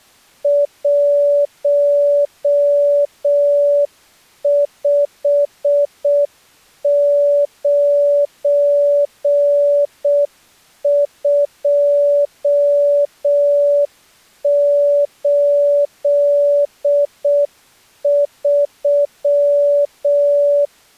Morse code, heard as a keyed tone, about 6 wpm, 580 Hz. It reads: 159283